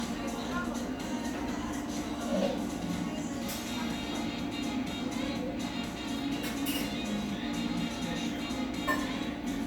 The noise of a cafe. There is no code.